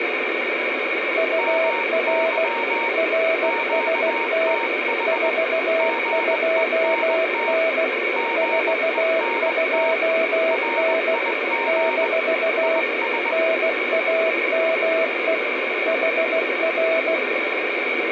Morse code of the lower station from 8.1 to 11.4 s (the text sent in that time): 42N